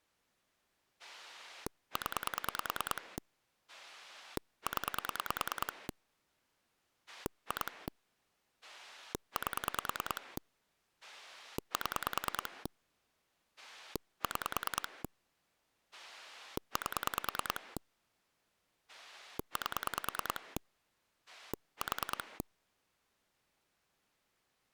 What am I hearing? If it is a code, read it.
Pulse dialling, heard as a rotary dial, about 9 pulses a second. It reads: 0 0 2 8 7 6 8 8 4